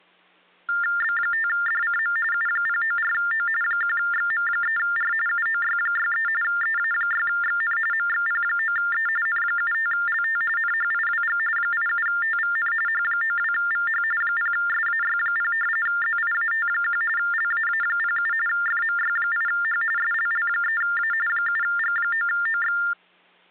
TTY/TDD text telephone tones (45.45 baud Baudot), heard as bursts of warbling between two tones, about 400 Hz shift, 1600 Hz centre. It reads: B5DCM U094O 1XM3R UOY63 EA6XN MXP9E N75LT NHIWG 87TVN H92VH 0SAY0 ZIAT1 LAA07 FMY8H SLL3A 7G9OX